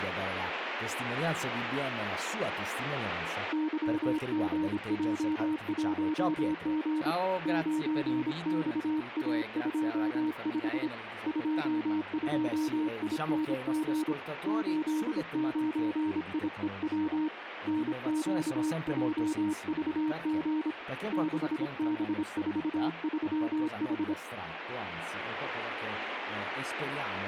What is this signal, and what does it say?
Morse code, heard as a keyed tone, hand-sent with a paddle, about 26 wpm, 310 Hz, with radio static. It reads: YGJ1G 9XA25 22ING 89IEW NQJVG 6B43H